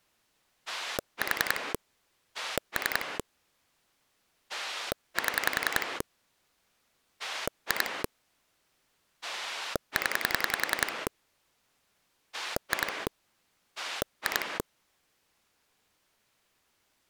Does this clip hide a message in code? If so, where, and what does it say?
Yes: pulse dialling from 0.7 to 14.6 s, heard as a rotary dial, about 10 pulses a second. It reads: 4 3 7 2 0 2 2